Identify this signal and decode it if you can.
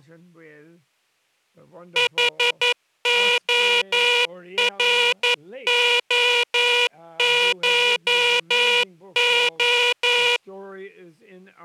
Morse code (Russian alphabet), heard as a buzzer, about 11 wpm. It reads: ХОРОШО